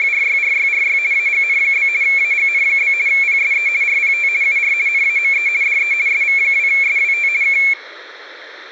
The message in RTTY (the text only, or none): … AGN? AGN? PSE RPT UR NAME DE SV2SWT K